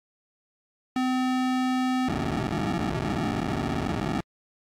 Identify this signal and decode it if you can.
POCSAG pager data (512 baud), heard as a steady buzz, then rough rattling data.